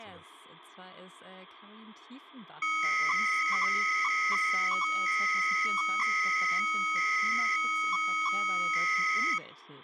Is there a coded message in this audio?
Yes: 300-baud modem data (Bell 103 tones) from 2.6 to 9.4 s, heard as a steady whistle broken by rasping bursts, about 300 baud, 200 Hz shift.